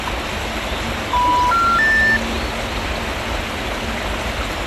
Telephone call progress tone (North American plan), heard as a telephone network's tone, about 980, 1370, 1800 Hz, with phone line noise and the noise of a park. Special information tone.